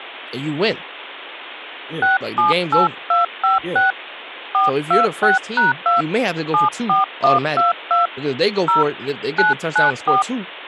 DTMF, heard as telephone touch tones, dialled by hand, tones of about 150 ms, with speech in English. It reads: 678256 426#2 74122 0 994